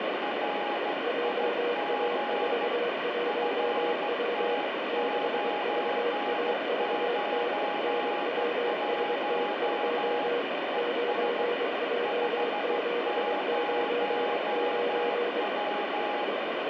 Morse code, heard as two keyed tones, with heavy radio static. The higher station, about 15 wpm, 830 Hz: RIG FT991 ES 50W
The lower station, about 23 wpm, 480 Hz: JA41W 6VAVT NWST2 9J799